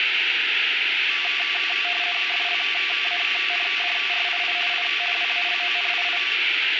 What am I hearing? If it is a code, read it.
RTTY (50 baud, 450 Hz shift), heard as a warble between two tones, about 930 Hz centre, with radio static. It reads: FLANDRII I WALONII